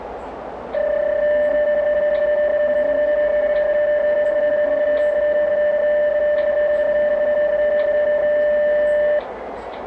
PSK31 (31.25 baud), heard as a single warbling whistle, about 600 Hz, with radio static, a narrow filter and the noise of a subway station.